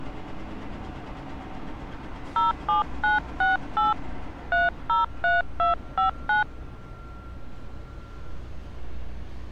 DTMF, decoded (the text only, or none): 07968 303259